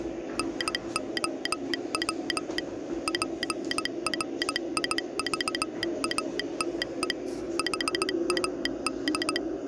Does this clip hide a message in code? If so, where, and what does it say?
Yes: Morse code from 0.3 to 9.4 s, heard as a telegraph sounder, machine-sent, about 17 wpm, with the noise of a subway station. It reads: NOW PRIVATE HAD